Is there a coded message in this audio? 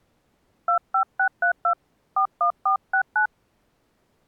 Yes: DTMF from 0.7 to 3.3 s, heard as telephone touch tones, dialled by hand, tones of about 90 ms. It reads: 25632 41469